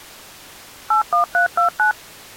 DTMF, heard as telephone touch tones, dialled by machine, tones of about 120 ms. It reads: 81329